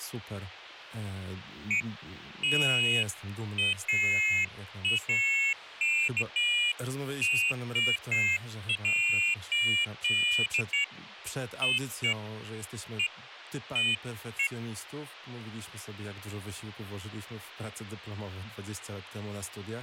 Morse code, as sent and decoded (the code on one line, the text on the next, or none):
none